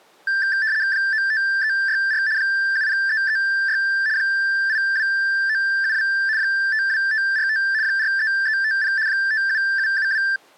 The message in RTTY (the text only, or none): 95364 70336 82972 52545 43350 57772